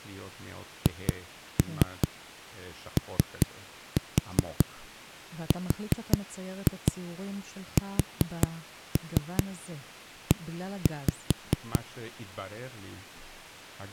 Tap code, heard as knocks on a wall, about 5 knocks a second, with speech in Hebrew. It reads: HORSE